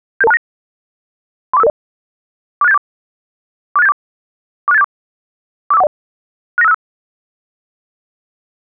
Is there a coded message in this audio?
Yes: five-tone selective call (EIA) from 0.2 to 6.7 s, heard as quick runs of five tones, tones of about 30 ms. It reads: 77269 34550 46874 46874 46874 45410 69565